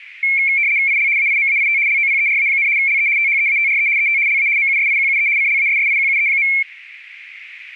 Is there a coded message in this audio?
Yes: RTTY (75 baud, 170 Hz shift) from 0.2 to 6.6 s, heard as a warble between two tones, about 2250 Hz centre. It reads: IL AIMAIT LOPERA, LE THEATRE ET LA MUSIQUE CLASSIQUE.